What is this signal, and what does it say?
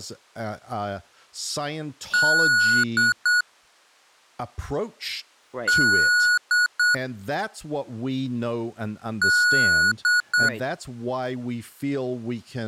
Beep code, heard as beeps from a small speaker, played three times, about 1460 Hz, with speech in English. 1 long, 2 short. In Award, IBM and AMI BIOS tables: video adapter failure.